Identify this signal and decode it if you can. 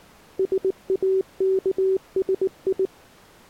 Morse code, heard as a keyed tone, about 19 wpm, 380 Hz. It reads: SAKSI